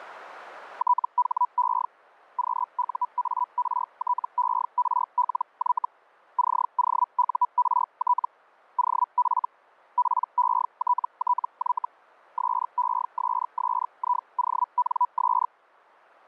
Hellschreiber (Feld-Hell, 122.5 baud), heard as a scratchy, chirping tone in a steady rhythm, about 980 Hz. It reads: THE QUARTERLY COURT OF PETTY SESSIONS